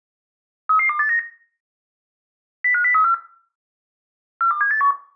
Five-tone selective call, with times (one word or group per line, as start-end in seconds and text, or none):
0.7-1.2 33289
2.6-3.1 05034
4.4-4.9 42781